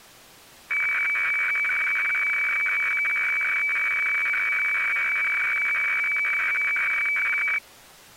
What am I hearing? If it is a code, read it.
Weather fax (radiofax), 120 lines a minute, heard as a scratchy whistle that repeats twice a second.